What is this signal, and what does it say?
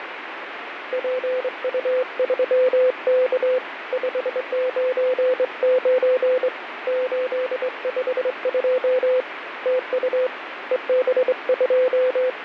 Morse code, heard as a keyed tone, hand-sent with a straight key, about 23 wpm, 510 Hz, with radio static. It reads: PU3K 599 852 TU …